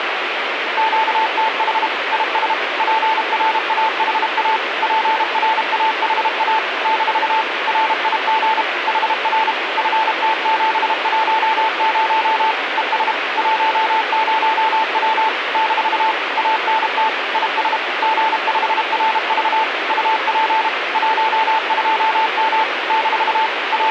Morse code, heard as a keyed tone, machine-sent, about 32 wpm, 880 Hz, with radio static. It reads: QTH IS PRAHA PRAHA - RIG HR FT710 ES 10W - ANT IS G5RV UP 12M - …